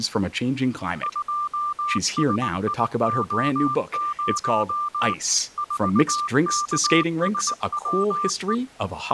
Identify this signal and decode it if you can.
Morse code, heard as a keyed tone, machine-sent, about 19 wpm, 1190 Hz, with speech in English. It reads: 2SIO0 4KSWE